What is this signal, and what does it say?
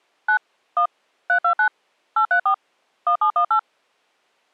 DTMF, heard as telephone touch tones, dialled by machine, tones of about 90 ms. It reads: 9 1 329 834 1718